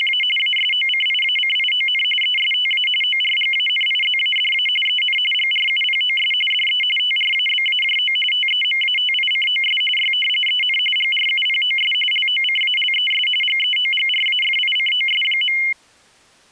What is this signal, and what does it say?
RTTY (45.45 baud, 850 Hz shift), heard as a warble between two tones, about 2550 Hz centre. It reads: … ASOCIACION ESTA ORGANIZADA EN GRUPOS DE TRABAJO TEMATICOS Y EN GRUPOS LOCALES GEOGRAFICOS.